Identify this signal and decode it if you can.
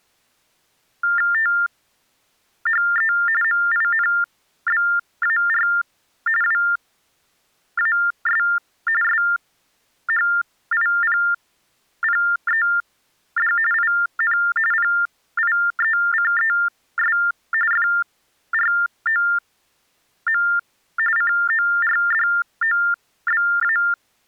TTY/TDD text telephone tones (45.45 baud Baudot), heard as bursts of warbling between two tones, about 400 Hz shift, 1600 Hz centre. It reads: THE MINBAR WAS SHIPPED IN PIECES FROM CORDOBA